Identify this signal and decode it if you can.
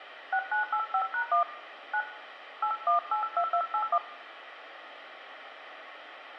DTMF, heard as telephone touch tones, dialled by hand, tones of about 90 ms, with radio hiss and room echo. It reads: 6985#1 9 8182281